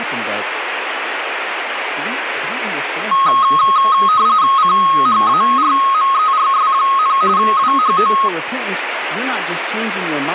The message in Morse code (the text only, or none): none